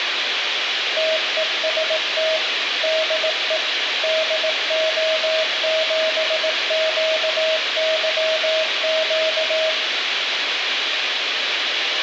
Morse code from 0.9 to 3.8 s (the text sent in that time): TEST DE